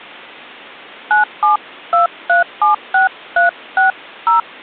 DTMF, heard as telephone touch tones, dialled by hand, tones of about 130 ms. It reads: 972376360